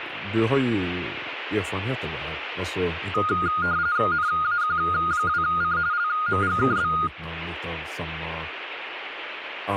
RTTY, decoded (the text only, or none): NAQ2C LMGKB